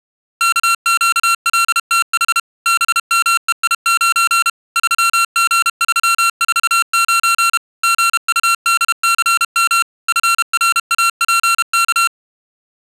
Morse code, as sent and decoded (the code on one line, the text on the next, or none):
-.- --.- .-.. - .... / -... -- . .. ----. / ...-- --. ...-- ....- ----. / --. ..- -.. -.-. -- / ..-. .-. .- .--. -.-
KQLTH BMEI9 3G349 GUDCM FRAPK